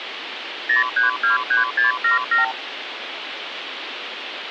Multi-frequency trunk signalling (R2, with the far end's replies), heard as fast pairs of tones, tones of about 140 ms, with phone line noise. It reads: 0323677